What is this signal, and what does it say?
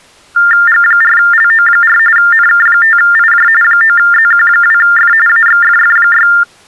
TTY/TDD text telephone tones (45.45 baud Baudot), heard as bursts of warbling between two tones, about 400 Hz shift, 1600 Hz centre. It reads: G4LO4 NK5IJ 9ZQ2F AXFF6